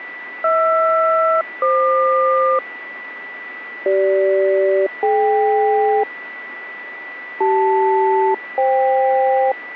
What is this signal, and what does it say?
Aircraft SELCAL, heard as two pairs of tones, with a steady whistle near 1970 Hz. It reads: HR-FQ CG-DK CL-FK